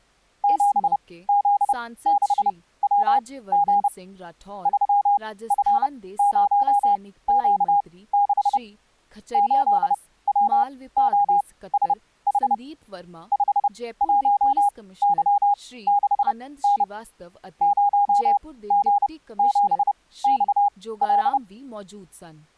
Morse code, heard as a keyed tone, machine-sent, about 30 wpm, spaced as for 18 wpm, 810 Hz, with speech in Punjabi. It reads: 7Z6WG 3F0Q6 8WOSH 51Y6N 0G7XL